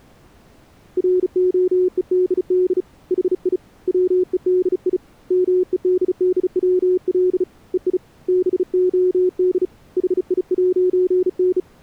Morse code, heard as a keyed tone, hand-sent with a bug key, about 35 wpm, 370 Hz. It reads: ROEDD HI WEDI MEDDWL EI BOD HI'N